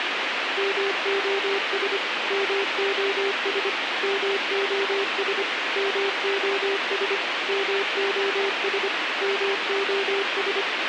Morse code, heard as a keyed tone, machine-sent, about 25 wpm, 400 Hz, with radio hiss and a squelch burst at the end. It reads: MOS MOS MOS MOS MOS MOS